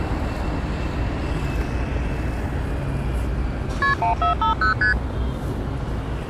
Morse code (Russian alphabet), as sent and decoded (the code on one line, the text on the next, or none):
none